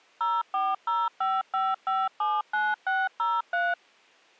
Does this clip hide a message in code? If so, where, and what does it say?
Yes: DTMF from 0.2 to 3.7 s, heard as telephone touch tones, dialled by machine, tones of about 210 ms. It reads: 04055579603